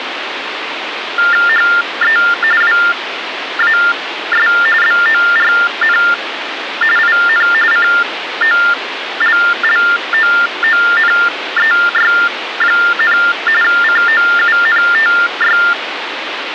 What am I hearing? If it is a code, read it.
TTY/TDD text telephone tones (45.45 baud Baudot), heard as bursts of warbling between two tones, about 400 Hz shift, 1600 Hz centre, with phone line noise. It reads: HE WAS BORN IN COLLOONEY, COUNTY